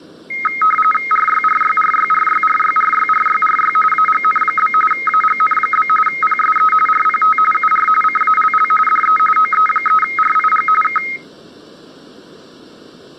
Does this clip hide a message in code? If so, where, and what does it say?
Yes: RTTY (45.45 baud, 850 Hz shift) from 0.3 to 11.2 s, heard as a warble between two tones, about 1700 Hz centre. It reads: RYRYRYRYRYRYRYRY AGN? AGN? PSE RPT UR CALL DE OE3RIG K